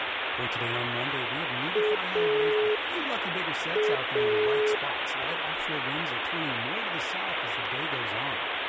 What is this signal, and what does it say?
Telephone call progress tone (pulsed, as in Italy), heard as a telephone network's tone, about 420 Hz, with phone line noise. Dial tone.